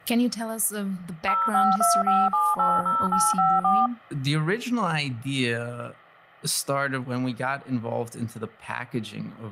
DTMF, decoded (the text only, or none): 0525780854